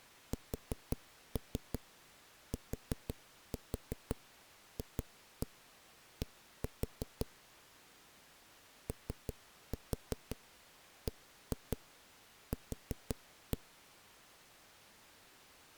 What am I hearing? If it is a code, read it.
Tap code, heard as knocks on a wall, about 5 knocks a second. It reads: STFD OBQ